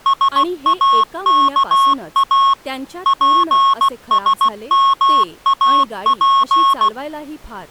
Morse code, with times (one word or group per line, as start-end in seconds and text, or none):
0.1-2.5 SAKA
3.1-6.9 PSMAP